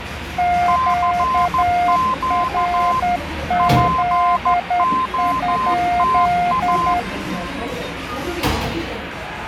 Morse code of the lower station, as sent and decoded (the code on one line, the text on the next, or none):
--.- .-. --.. ..--..
QRZ?